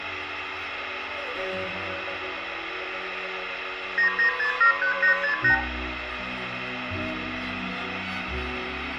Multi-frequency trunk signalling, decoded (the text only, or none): 99673868